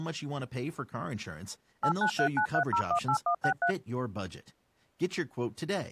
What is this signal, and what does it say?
DTMF, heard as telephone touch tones, dialled by machine, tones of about 90 ms, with speech in English. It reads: 89393018163